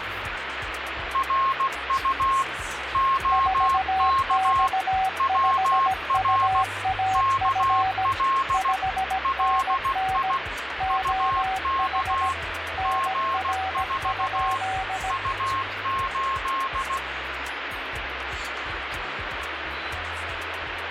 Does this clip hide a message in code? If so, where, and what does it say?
Yes: Morse code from 1.1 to 17.0 s, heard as two keyed tones, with radio static. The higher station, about 16 wpm, 1070 Hz: RU OK WR KL LI UK G4 U8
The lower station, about 17 wpm, 760 Hz: 4X5UAF 5NN OH NR?